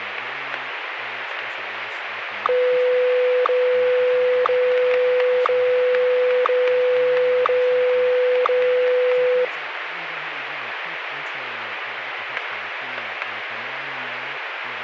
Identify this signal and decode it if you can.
Radio time signal (WWVH, Hawaii), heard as ticks, one a second, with radio static.